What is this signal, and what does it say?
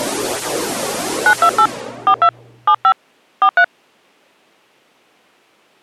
DTMF, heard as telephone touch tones, dialled by hand, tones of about 70 ms. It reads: 928 42 75 43